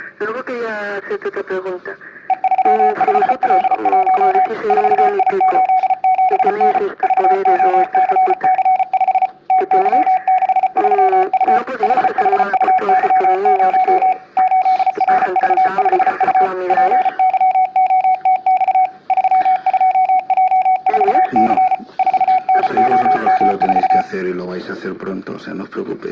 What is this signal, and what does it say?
Morse code, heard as a keyed tone, machine-sent, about 34 wpm, 740 Hz, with room echo. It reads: E35L1 4I87N VOCC5 TY63U HHUY0 8RV5U PYOTX 32J4C 4NOM4